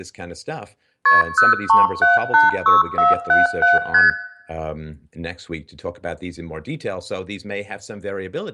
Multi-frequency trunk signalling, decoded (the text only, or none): KP 03786477 ST